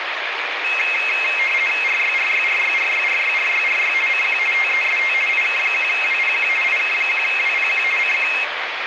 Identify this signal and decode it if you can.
RTTY (50 baud, 450 Hz shift), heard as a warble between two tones, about 2350 Hz centre, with radio static. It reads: RYRYRYRYRYRYRY CQ TEST IK1WPQ IK1WPQ CQ